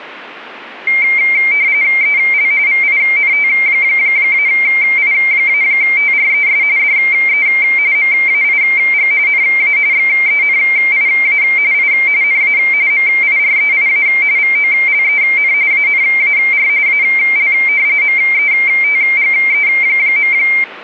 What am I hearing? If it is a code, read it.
RTTY (45.45 baud, 170 Hz shift), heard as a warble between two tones, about 2200 Hz centre. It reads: EL VINT-I-TRES DE MAIG NA XENIA I NA MIREIA VOLEN ANAR AL METGE.